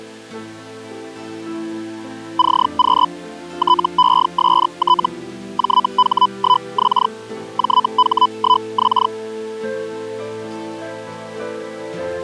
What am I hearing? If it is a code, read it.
Hellschreiber (Feld-Hell, 122.5 baud), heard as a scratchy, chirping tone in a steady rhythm, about 1000 Hz. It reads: CQ TEST JH1X JH1X